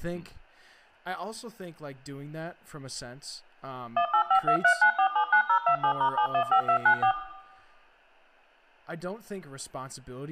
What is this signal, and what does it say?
DTMF, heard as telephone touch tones, dialled by machine, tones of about 90 ms, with room echo and speech in English. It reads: 185239479027*715294